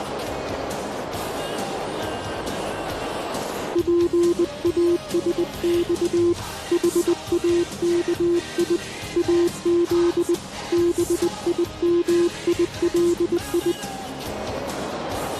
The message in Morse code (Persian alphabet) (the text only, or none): پاسخ حاکی از بیمیلی